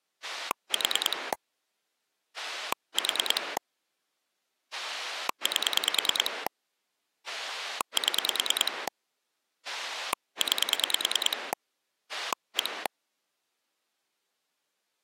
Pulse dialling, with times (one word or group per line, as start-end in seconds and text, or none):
0.2-1.3 4
2.4-3.6 4
4.7-6.5 8
7.3-8.9 7
9.6-11.5 9
12.1-12.9 1